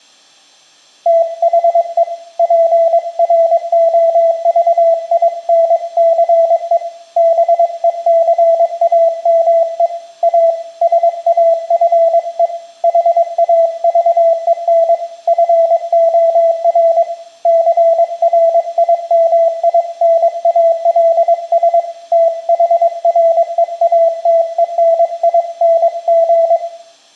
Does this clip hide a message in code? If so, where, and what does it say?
Yes: Morse code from 1.0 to 26.6 s, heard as a keyed tone, hand-sent with a paddle, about 22 wpm, 660 Hz, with room echo. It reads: THE PROVINCE BECAME A SAFE HAVEN FOR CRIMINALS THREATENING